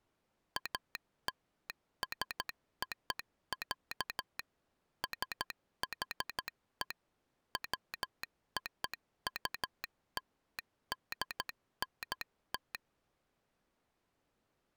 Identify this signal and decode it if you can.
Morse code (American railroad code), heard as a telegraph sounder, machine-sent. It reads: ALSO, SHE WOULDNT